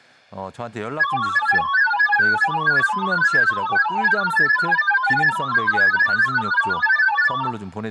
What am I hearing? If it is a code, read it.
Multi-tone FSK (Olivia or MFSK type), about 1000 Hz wide, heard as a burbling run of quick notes, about 31.25 baud, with speech in Korean.